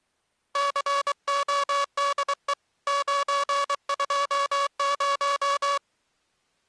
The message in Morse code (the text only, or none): CODE 920